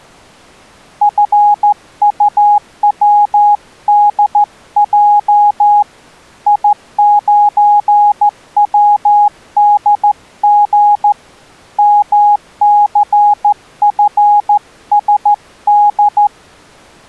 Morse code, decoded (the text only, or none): FUWDJ I9WDG MCFSD